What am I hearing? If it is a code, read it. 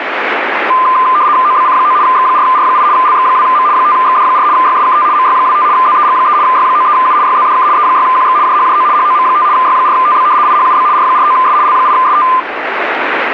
RTTY (75 baud, 170 Hz shift), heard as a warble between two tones, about 1110 Hz centre, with radio static. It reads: OBC9 X4R8 LX2M 5XD4 YSKT MY25 ZEG3 Y93U YZDK E6QX JHJO HOM5 Y4TB IHUB R49S L8ST